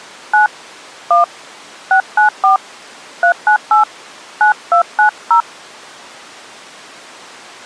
DTMF, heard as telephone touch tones, dialled by hand, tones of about 120 ms. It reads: 9 1 694 398 9290